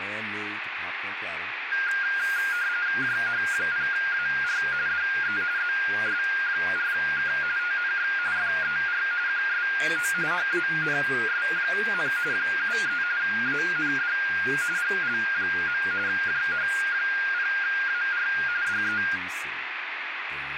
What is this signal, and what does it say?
RTTY (45.45 baud, 170 Hz shift), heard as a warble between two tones, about 1500 Hz centre, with radio static and speech in English. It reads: JH0AR DE ZS4K TNX FER QSO HANS, 73 AND GL. JH0AR DE